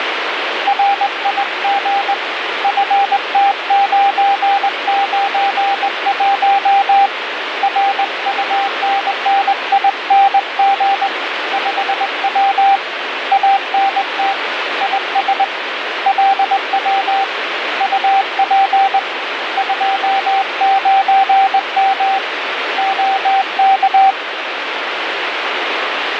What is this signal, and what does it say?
Morse code, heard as a keyed tone, hand-sent with a straight key, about 20 wpm, 790 Hz, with radio static. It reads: RIG FT991 RUNNING 5W ANT IS LW UP 29M OK